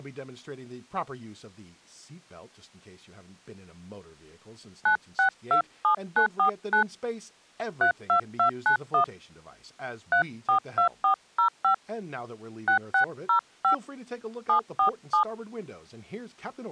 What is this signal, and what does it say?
DTMF, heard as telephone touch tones, dialled by hand, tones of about 100 ms, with speech in English. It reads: 9627949 32291 342405 6605 747